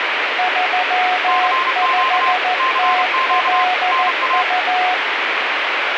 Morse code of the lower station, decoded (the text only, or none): 35TLU